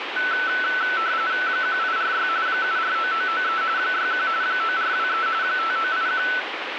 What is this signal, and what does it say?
RTTY (45.45 baud, 170 Hz shift), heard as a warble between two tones, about 1420 Hz centre, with radio static. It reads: 1846 749993 61 9423 5981